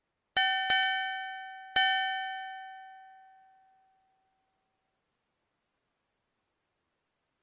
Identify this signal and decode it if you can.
Ship's bell, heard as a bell. 3. Three half-hours of the watch have passed.